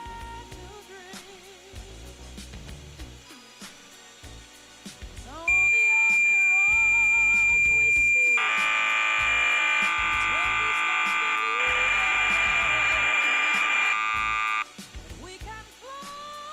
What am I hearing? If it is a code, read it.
Cassette data (Kansas City type), 1200 baud, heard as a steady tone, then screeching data.